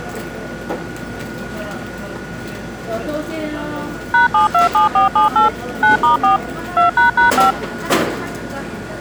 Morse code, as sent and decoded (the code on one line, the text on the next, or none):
none